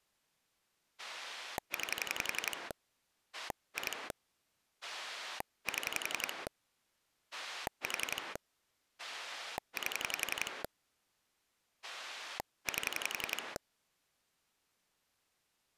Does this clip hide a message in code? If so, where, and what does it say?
Yes: pulse dialling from 1.0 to 13.6 s, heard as a rotary dial, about 11 pulses a second. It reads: 9 2 7 4 8 8